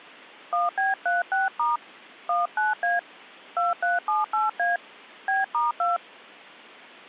DTMF, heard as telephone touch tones, dialled by hand, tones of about 160 ms. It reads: 1B36* 19A 2378A B*2